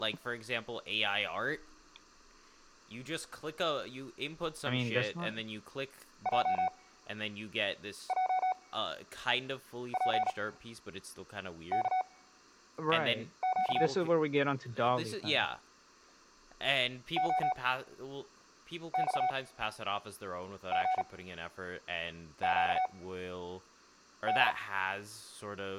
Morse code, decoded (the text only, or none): JJPKQ OXGQD